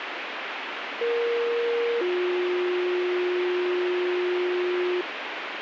Two-tone page, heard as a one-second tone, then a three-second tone, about 470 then 360 Hz, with radio hiss.